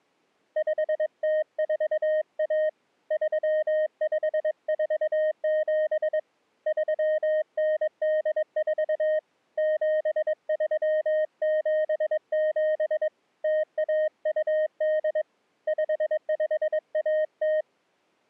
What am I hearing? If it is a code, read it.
Morse code (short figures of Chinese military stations), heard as a keyed tone, hand-sent with a paddle, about 22 wpm, 620 Hz. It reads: 5041 3547 3984 7377 0128 5510